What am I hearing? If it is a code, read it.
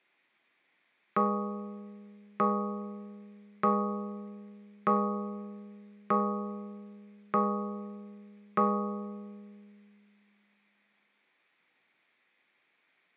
Clock strike, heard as a bell, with room echo. 7. Seven o'clock.